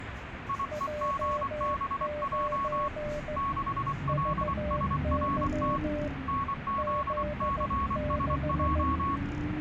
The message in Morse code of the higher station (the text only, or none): IEGBJ 6LSRT NZCSJ